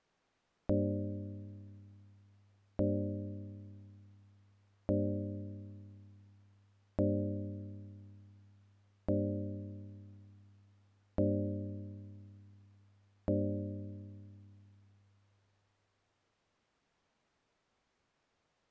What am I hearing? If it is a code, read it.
Clock strike, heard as a bell. 7. Seven o'clock.